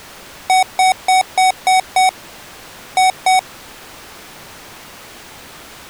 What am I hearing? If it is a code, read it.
Beep code, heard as beeps from a small speaker, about 750 Hz. 6-2.